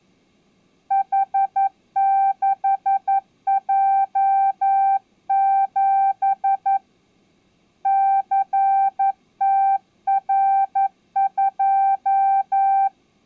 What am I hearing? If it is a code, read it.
Morse code, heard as a keyed tone, hand-sent with a paddle, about 11 wpm, 780 Hz. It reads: H6J7 CTR2